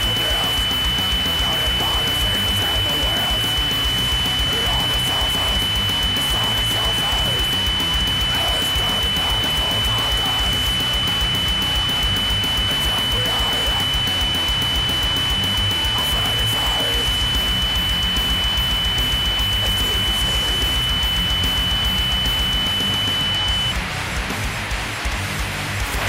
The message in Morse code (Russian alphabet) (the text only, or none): none